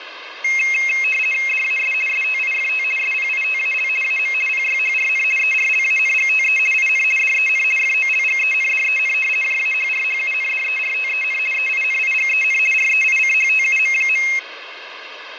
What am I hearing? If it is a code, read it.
RTTY (50 baud, 450 Hz shift), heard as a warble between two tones, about 2350 Hz centre, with radio static. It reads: DAS STIFT SPITAL AM PYHRN ERLANGTE IN DEN FOLGENDEN JAHRHUNDERTEN EINIGEN REICHTUM.